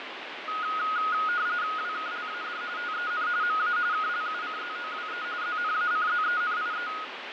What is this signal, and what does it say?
RTTY (45.45 baud, 170 Hz shift), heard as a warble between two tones, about 1350 Hz centre, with radio static and fading. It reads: WKLAD TEN MA KLUCZOWE ZNACZENIE